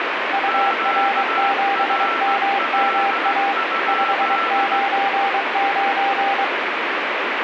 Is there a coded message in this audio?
Yes: Morse code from 0.3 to 6.5 s, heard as two keyed tones, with heavy radio static. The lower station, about 23 wpm, 790 Hz: UR7MMA 599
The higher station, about 17 wpm, 1340 Hz: QRL?